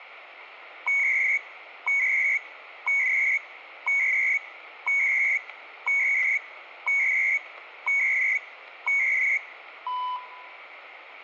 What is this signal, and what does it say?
Radio time signal (CHU, Canada), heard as beeps and data bursts, one a second, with radio static and room echo.